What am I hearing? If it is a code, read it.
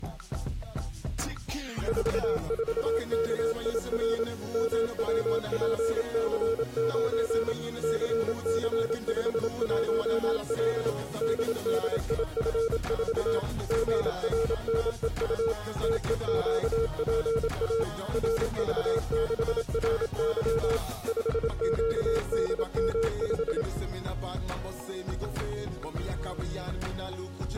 Morse code, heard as a keyed tone, machine-sent, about 27 wpm, 450 Hz. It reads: 44KIR MWPC9 CC51L DDIF4 GRNEU TEQPA RV6RY 5QDM5